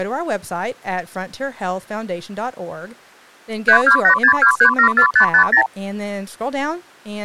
Multi-frequency trunk signalling (R2, with the far end's replies), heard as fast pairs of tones, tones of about 90 ms, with speech in English. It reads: 32862374550